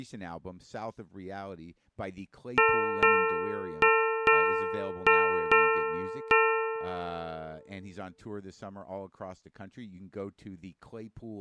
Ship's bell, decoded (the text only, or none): 7